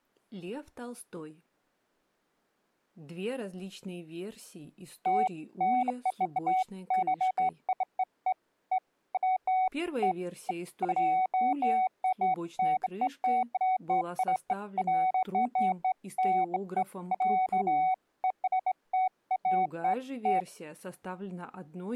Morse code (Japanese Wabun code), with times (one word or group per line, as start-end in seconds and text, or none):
none